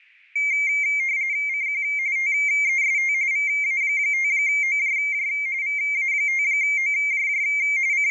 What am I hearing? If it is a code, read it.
RTTY (45.45 baud, 170 Hz shift), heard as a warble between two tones, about 2200 Hz centre. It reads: CQ TEST VA5OJJ VA5OJJ …